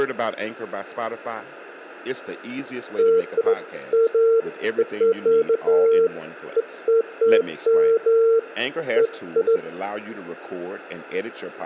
Beeps of irregular length, with hum and speech in English. There is no code.